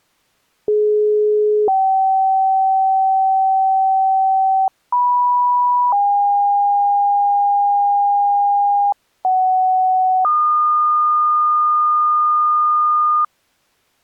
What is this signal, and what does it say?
Two-tone page, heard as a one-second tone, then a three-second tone, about 420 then 770 Hz, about 980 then 810 Hz, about 750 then 1220 Hz.